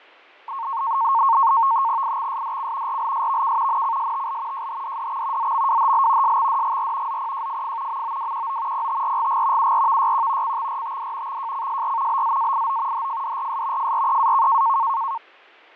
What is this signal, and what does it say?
NAVTEX (SITOR-B), 100 baud, 170 Hz shift, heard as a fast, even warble, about 1000 Hz centre, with fading. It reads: IXSDC RLSVK NCSTL JHDDX ZMWHL SXDGR ZPJFF MOWQO PTRGG URVYQ CXRTD XJCSR BZAIO HFDRS FREAK